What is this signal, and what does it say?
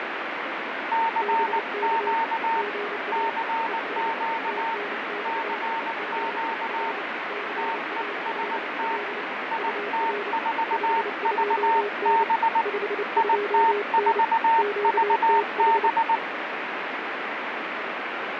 Morse code, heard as two keyed tones, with heavy radio static and fading. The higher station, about 19 wpm, 910 Hz: CQ CQ CQ TEST IT4VB IT4VB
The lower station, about 29 wpm, 410 Hz: BK GA ES TNX FER CALL UR 52N 52N QTH